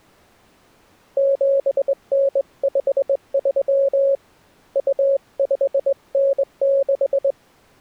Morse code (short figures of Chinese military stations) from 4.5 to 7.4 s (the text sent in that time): 2596